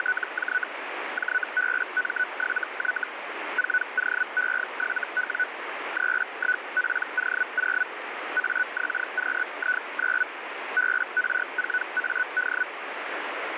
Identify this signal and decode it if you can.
Hellschreiber (Feld-Hell, 122.5 baud), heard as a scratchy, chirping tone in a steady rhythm, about 1490 Hz, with radio static. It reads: … JBM7Y 4OE7W 31PO0 AXQI9 BR4AD